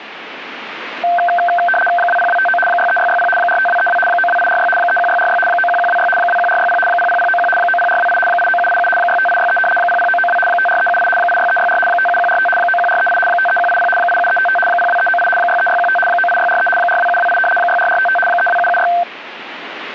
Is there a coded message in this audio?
Yes: RTTY (75 baud, 850 Hz shift) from 1.0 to 19.0 s, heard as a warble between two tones, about 1120 Hz centre, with radio static. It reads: 20259 63660 45232 92846 31646 91126 21460 00091 90428 89787 65863 00992 54378 86364 57145 91438 53180 87355 02398 63615 98643 42728 64455 32776